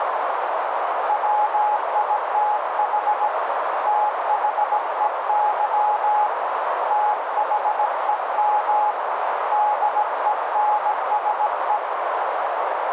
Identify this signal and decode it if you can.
Morse code, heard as a keyed tone, hand-sent with a paddle, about 17 wpm, 840 Hz, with heavy radio static and a narrow filter. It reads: WITH THEY THEM DENSE